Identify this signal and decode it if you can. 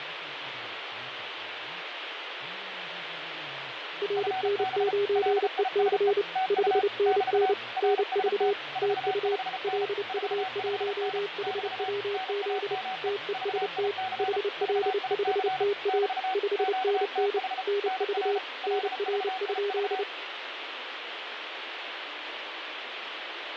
Morse code, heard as two keyed tones, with radio static and fading. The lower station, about 29 wpm, 410 Hz: RN9EC 5NN NV TU LU1HWZ TEST HL5TA 5NN NV NR?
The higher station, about 34 wpm, 750 Hz: FB LISE TU <BT> RST 45N 45N <BT> NAME VIC VIC <BT> QTH NR LVIV